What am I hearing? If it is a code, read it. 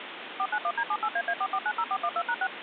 DTMF, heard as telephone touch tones, dialled by machine, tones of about 60 ms, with phone line noise. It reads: 491D78AA4490412#6